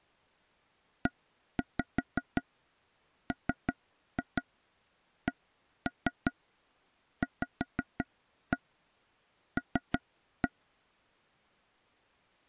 Tap code, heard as taps on a table, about 5 knocks a second. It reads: EMCVL